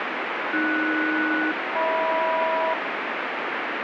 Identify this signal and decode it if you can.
Aircraft SELCAL, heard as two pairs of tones, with heavy radio static. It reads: AS-HM